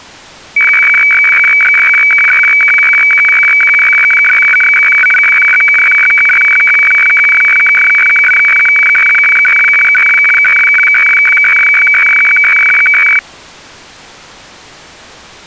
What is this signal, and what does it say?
Weather fax (radiofax), 120 lines a minute, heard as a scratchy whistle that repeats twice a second.